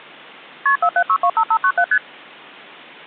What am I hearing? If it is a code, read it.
Multi-frequency trunk signalling (R1, as on North American trunks), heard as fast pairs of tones, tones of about 70 ms. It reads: KP 47625597 ST